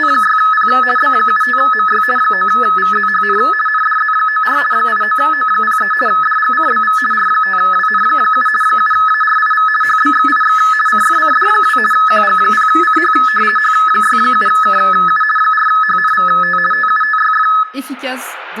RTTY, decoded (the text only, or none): … B75MY 9VZHN NDZ94 89O03 DGCBV R5WN7 7ARIV HBXIX CFCD2 QG0CH H67KU 4HNVT TUTYF